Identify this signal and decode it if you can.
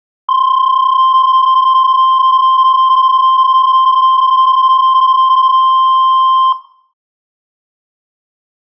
PSK31 (31.25 baud), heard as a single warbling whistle, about 1050 Hz, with room echo.